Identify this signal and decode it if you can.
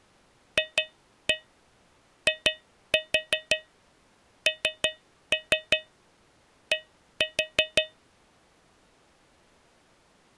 Tap code, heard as taps on a metal pipe, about 5 knocks a second. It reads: FIND